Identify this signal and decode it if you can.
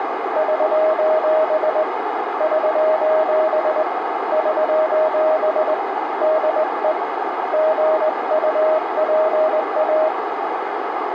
Morse code, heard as a keyed tone, hand-sent with a straight key, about 20 wpm, 630 Hz, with radio static and a narrow filter. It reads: <SOS> <SOS> <SOS> DE GUPA